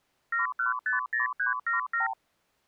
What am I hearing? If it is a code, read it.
Multi-frequency trunk signalling (R2, with the far end's replies), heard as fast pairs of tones, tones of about 130 ms. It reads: 7150377